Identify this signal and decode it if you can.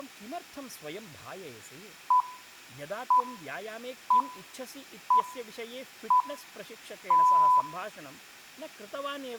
Radio time signal (six pips, as the Greenwich Time Signal), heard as pips, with room echo and speech in Sanskrit.